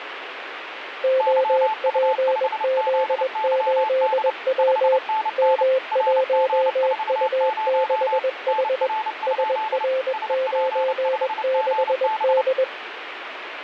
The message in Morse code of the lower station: OPZ8W M1U6H SR96D

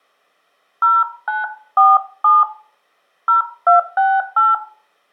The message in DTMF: 0947 0268

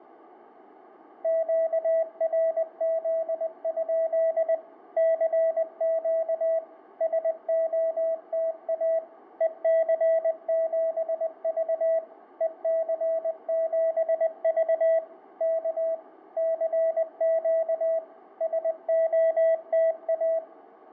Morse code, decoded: QRZ? CQ SOTA EC7V EC7V K CQ SOTA

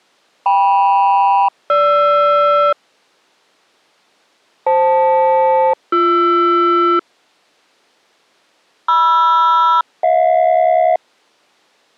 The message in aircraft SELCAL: KM-GR FL-BR MR-HJ

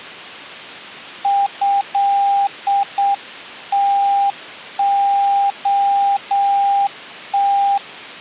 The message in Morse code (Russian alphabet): ЭТОТ

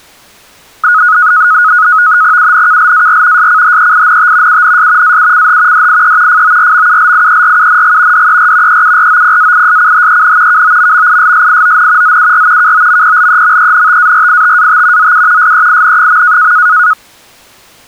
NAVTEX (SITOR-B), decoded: UNKLAR SCHEINT UNS AUCH DIE FORMULIERUNG DER EUROPAISCHEN KOMMISSION ZUR KOMPLEMENTARITAT ZU SEIN.

